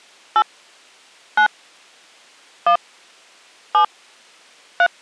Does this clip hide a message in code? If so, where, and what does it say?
Yes: DTMF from 0.4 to 4.9 s, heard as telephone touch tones, dialled by hand, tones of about 80 ms. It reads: 8 9 1 7 3